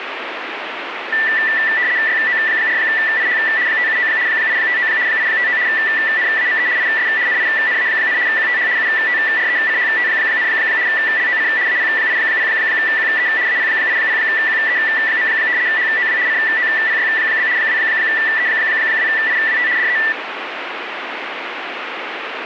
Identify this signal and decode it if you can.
RTTY (75 baud, 170 Hz shift), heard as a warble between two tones, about 1850 Hz centre, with radio static. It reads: YO4IH 579 859 859 NAME IS NINA, QTH UTRECHT, LOC AP80QE AP80QE. HOW COPY? 2E2IWT DE